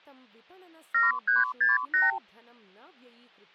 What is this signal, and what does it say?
Multi-frequency trunk signalling (R2, with the far end's replies), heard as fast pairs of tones, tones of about 160 ms, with hum and speech in Sanskrit. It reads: 7368